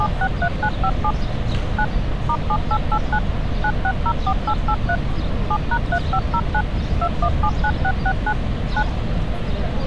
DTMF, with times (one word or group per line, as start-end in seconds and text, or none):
0.0-1.1 763957
1.8-1.8 9
2.3-3.2 *7889
3.6-5.0 9604883
5.5-6.6 7#3509
7.0-8.3 2179669
8.8-8.8 9